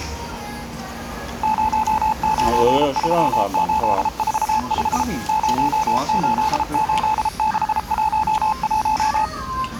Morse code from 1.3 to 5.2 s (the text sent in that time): 093845